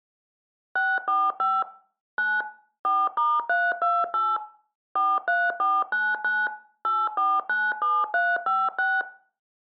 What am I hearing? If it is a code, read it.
DTMF, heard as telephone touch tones, dialled by machine, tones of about 220 ms, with room echo. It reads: 645 9 4*328 43499 8497356